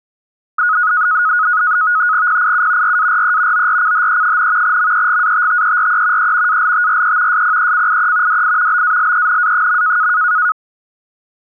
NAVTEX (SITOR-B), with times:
2.3-3.0 PIU
2.8-3.7 RARE
3.5-4.8 ORCHE,
4.6-6.3 MEGATTERE
6.2-6.6 E
6.5-7.4 ALTRE
7.3-8.4 SPECIE
8.3-8.8 DI
8.7-10.1 BALENA.

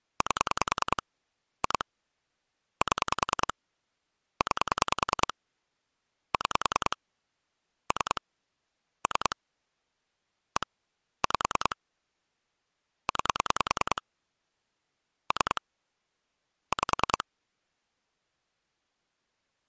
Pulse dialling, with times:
0.2-1.0 8
1.6-1.8 2
2.8-3.5 7
4.4-5.3 9
6.3-7.0 6
7.9-8.2 3
9.1-9.4 3
10.6-10.7 1
11.2-11.8 5
13.1-14.0 9
15.3-15.6 3
16.7-17.2 5

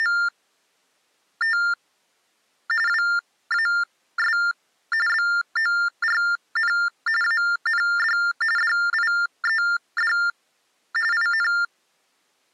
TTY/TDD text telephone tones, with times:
0.0-1.6 …
2.9-4.4 WAS
5.1-6.7 BORN
7.2-8.2 AND
8.6-10.1 DIED
11.1-11.5 IN

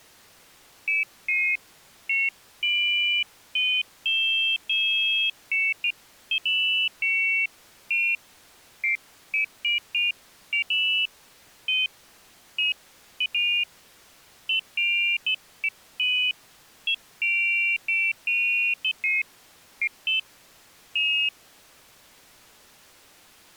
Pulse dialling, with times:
none

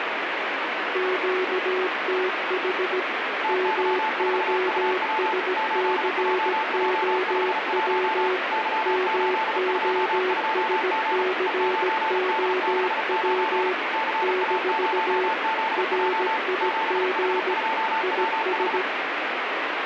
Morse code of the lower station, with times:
1.0-3.0 QTH
3.5-8.4 MOSCOW
8.9-13.7 MOSCOW
14.2-15.3 -
15.8-17.5 RIG
18.0-18.8 IS

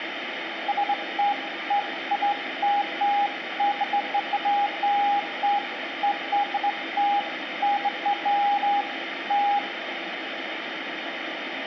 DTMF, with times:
none

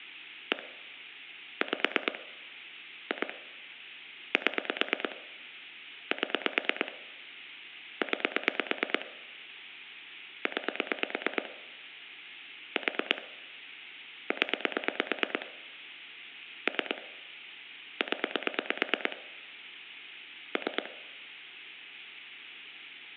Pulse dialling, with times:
0.5-0.6 1
1.6-2.2 5
3.1-3.3 2
4.3-5.2 7
6.1-6.9 7
8.0-9.1 9
10.5-11.5 9
12.8-13.2 4
14.3-15.5 0
16.7-17.0 3
18.0-19.2 0
20.6-20.9 3

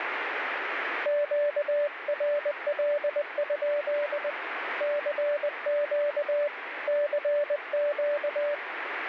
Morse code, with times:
1.1-4.3 QRL?
4.8-6.5 CQ
6.9-8.5 CQ

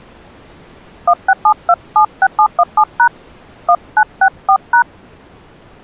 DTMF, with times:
1.1-3.1 167276717#
3.7-4.8 1964#

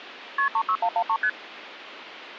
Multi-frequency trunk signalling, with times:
0.4-0.5 KP
0.5-1.2 36113
1.2-1.3 ST

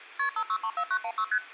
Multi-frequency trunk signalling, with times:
0.2-0.3 KP
0.4-1.2 5634916
1.3-1.4 ST

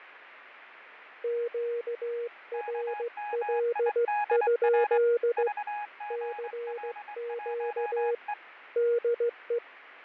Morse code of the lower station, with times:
1.2-5.5 QRL?
6.1-8.1 CQ
8.8-9.6 DE

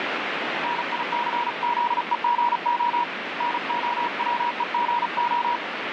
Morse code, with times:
0.6-3.0 NICZEGO
3.4-5.6 NOWEGO

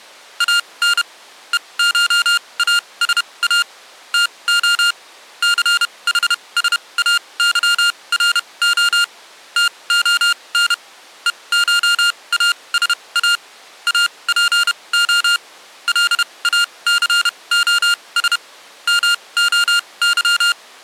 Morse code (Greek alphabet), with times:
0.4-1.0 ΑΝ
1.5-3.6 ΕΧΑΣΑ
4.1-4.9 ΤΟ
5.4-9.0 ΘΗΣΑΥΡΟ
9.6-10.7 ΤΟΝ
11.3-13.4 ΕΧΑΣΑ
13.9-15.4 ΑΠΟ
15.9-18.4 ΛΑΘΟΣ
18.9-20.5 ΜΟΥ

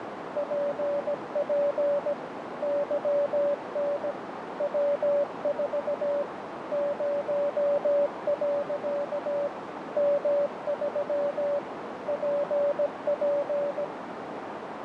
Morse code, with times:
0.4-2.1 PP
2.6-4.1 YN
4.6-6.2 W4
6.7-9.5 0.
10.0-11.6 M3
12.1-13.8 PP

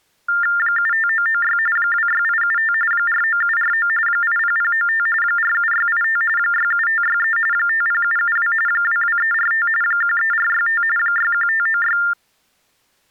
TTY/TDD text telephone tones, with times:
0.6-1.6 75996
1.8-2.7 26875
2.9-3.9 49749
4.1-5.1 80095
5.2-6.2 47685
6.4-7.4 67563
7.5-8.5 50772
8.7-9.7 22345
9.8-10.8 13465
11.0-12.0 61596

